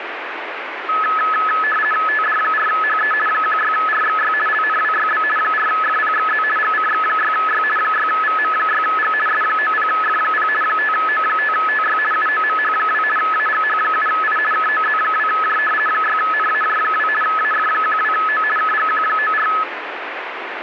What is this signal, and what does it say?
RTTY (50 baud, 450 Hz shift), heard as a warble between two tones, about 1500 Hz centre, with radio static. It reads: TD4HE 16RXY LNWYB 4FPXZ GCX6Y 6VM6G S90F0 5O5TY UOMH2 AGH7I KOZ2J 6NAJ2 AF12O KGQ94